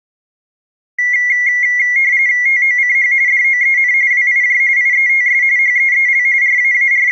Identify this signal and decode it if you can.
RTTY (45.45 baud, 170 Hz shift), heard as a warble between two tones, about 2050 Hz centre. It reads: TOCH DOEN WIJ IETS HEEL …